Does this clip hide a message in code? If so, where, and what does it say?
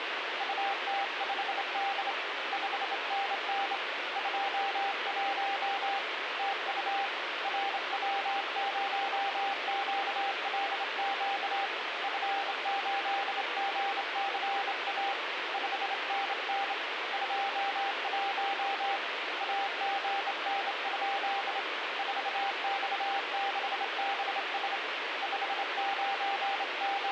Yes: Morse code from 0.3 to 27.1 s, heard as a keyed tone, hand-sent with a straight key, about 27 wpm, 790 Hz, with radio static. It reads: UT5D 5NN 21 TU RW0QLQ F8GCA 5NN 21 AGN? 4X6BS …